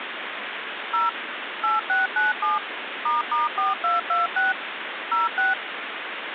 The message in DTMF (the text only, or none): 0 8697 **4226 06